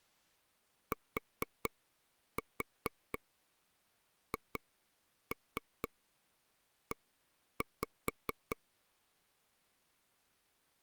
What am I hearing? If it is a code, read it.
Tap code, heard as taps on a table, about 4 knocks a second. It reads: THE